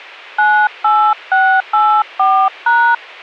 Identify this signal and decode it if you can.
DTMF, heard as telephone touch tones, dialled by hand, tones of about 290 ms, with a squelch burst at the end. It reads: 98684#